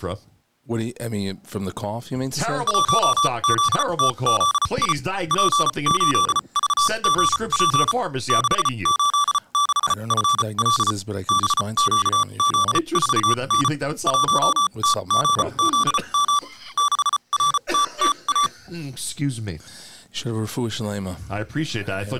Morse code, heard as electronic beeps, machine-sent, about 34 wpm, spaced as for 28 wpm, 1160 Hz. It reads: 1ZTZI P8VGP 686FL BQZ4N 1TGZM 6RTTA